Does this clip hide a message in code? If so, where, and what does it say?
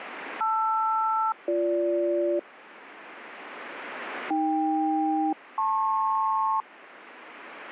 Yes: aircraft SELCAL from 0.4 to 6.6 s, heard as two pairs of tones. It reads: LR-BG AK-LP